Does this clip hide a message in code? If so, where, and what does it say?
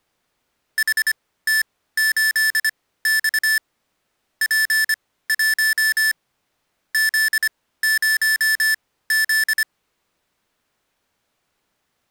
Yes: Morse code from 0.7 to 9.7 s, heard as electronic beeps, machine-sent, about 25 wpm, spaced as for 16 wpm, 1750 Hz. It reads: HT8X P1 Z0Z